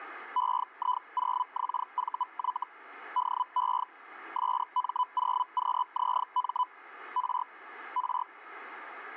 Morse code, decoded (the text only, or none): none